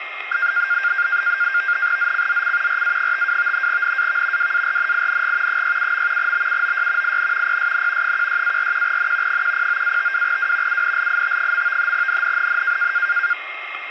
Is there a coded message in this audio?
Yes: NAVTEX (SITOR-B), 100 baud, 170 Hz shift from 0.3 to 13.3 s, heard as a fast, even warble, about 1500 Hz centre, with radio static and a steady whistle near 2130 Hz. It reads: ZCZC RA52 NAV WARNING 67. BUOY IN PSN 16-41N 109-52W UNLIT. NNNN